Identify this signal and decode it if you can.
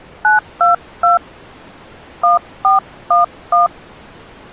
DTMF, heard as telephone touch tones, dialled by hand, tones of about 140 ms. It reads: 922 1411